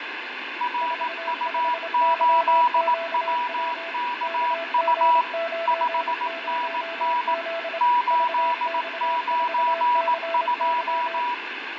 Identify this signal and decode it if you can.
Morse code, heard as two keyed tones, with radio static, fading and room echo. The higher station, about 18 wpm, 970 Hz: RU8WKU 5NN 892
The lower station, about 26 wpm, 670 Hz: 45YQW KG90Z VX4CY